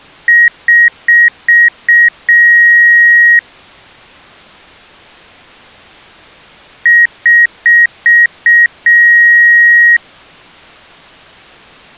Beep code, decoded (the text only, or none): 5 short, 1 long